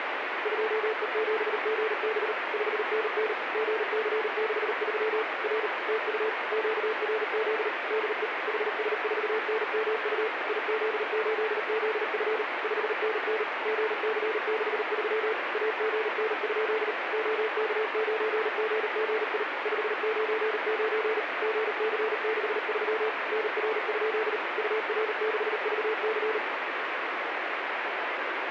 Morse code, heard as a keyed tone, machine-sent, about 38 wpm, 440 Hz, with radio static. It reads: 2E7GB 5NN GC63 R TU QRZ DE HS4NMU IZ8ZF 5NN GC63 AGN? OK9GGI 599 GC63 NR? UR6VC